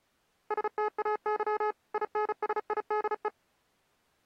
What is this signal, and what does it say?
Morse code, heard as electronic beeps, machine-sent, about 35 wpm, 420 Hz. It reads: STAY INSIDE